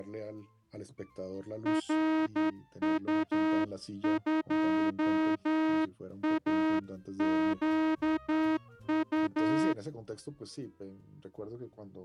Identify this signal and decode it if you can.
Morse code, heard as a horn, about 10 wpm. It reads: RU2AQU